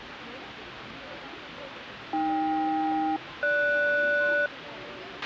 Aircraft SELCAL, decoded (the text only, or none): AK-GS